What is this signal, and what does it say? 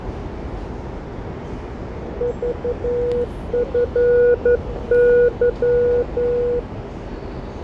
Morse code, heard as a keyed tone, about 11 wpm, 480 Hz, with radio static, fading, static crashes and the noise of a subway station. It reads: VFY